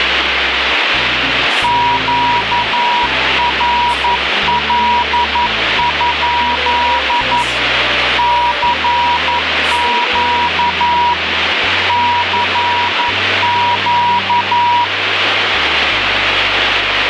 Morse code, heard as a keyed tone, machine-sent, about 11 wpm, 960 Hz, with radio static. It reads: QRL? CQ CQ